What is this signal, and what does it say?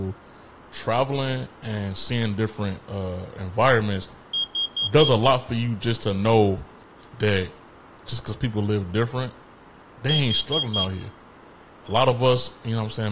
Alarm pattern, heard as an alarm's beeps, played twice, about 3250 Hz, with room echo and speech in English. Temporal four. Carbon monoxide.